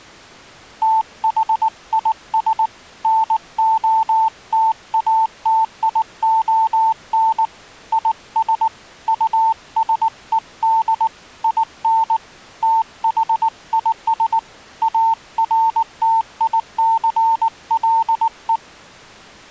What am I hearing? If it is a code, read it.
Morse code, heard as a keyed tone, hand-sent with a paddle, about 19 wpm, 890 Hz. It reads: THIS NOTATION IS USED IN THIS ARTICLE